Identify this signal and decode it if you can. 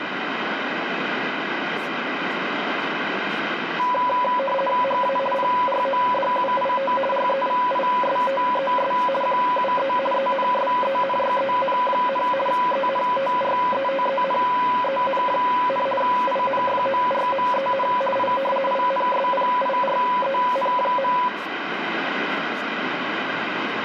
RTTY (50 baud, 450 Hz shift), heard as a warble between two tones, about 770 Hz centre, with radio static and room echo. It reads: HA PRODUIT REVISTES QUE ENSENYEN, ENTRETENEN, INFORMEN I INSPIREN.